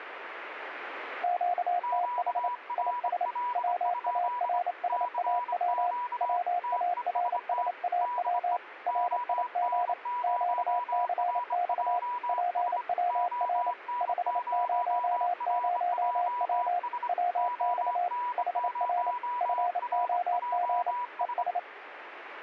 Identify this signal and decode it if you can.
Morse code, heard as two keyed tones, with radio static. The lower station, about 28 wpm, 710 Hz: QTH IS WARSAW WARSAW RIG QCX PWR 500W WX HR FOG ES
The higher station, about 25 wpm, 980 Hz: QRL? CQ TEST DE ON0RJS ON0RJS ON0RJS